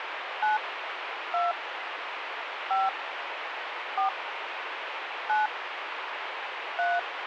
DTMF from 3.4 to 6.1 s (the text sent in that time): 4 9